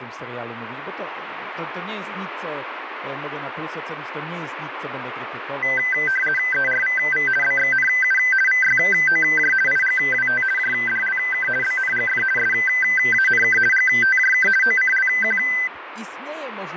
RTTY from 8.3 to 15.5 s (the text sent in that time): VYOJ IGWT JDLK BNGF SANK GTJK OCLQ